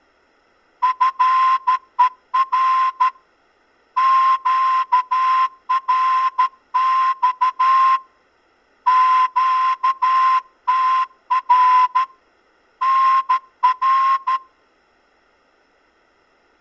Morse code, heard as a whistle, hand-sent with a straight key, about 13 wpm. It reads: FER QRX QTR NR